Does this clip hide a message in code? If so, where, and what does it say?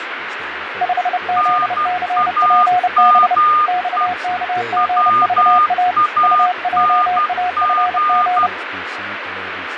Yes: Morse code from 0.8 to 8.5 s, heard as two keyed tones, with radio static, fading and speech in English. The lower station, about 30 wpm, 720 Hz: 5ZCPB XKGVA UJAFG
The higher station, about 12 wpm, 1220 Hz: NAME WANG